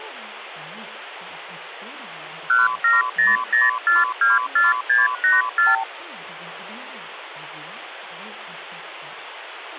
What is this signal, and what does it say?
Multi-frequency trunk signalling (R2, with the far end's replies), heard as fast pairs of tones, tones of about 170 ms, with phone line noise. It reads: 1700424684